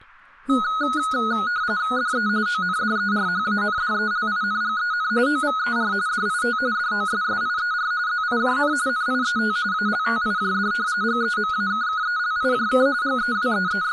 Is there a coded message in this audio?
Yes: RTTY (45.45 baud, 170 Hz shift) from 0.5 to 13.9 s, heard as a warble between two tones, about 1360 Hz centre, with speech in English. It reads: DE ONDERHANDELINGEN OVER DIT DOSSIER ZIJN NIET ALTIJD GEMAKKELIJK …